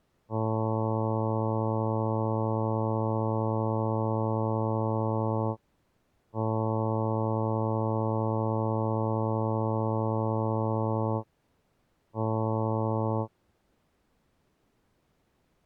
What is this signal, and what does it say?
Ship horn signal, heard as a ship's horn, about 110 Hz. 2 long, 1 short. At sea: I intend to overtake on your starboard side.